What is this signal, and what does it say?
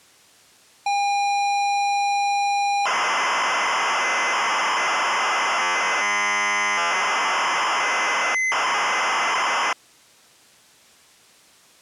ZX Spectrum tape loading, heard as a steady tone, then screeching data.